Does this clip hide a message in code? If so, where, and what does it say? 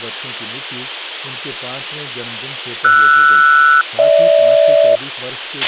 Yes: aircraft SELCAL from 2.8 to 5.0 s, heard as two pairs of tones, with a squelch burst at the end and speech in Hindi. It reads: RS-GH